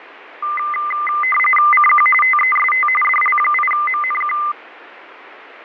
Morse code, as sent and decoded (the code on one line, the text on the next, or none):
none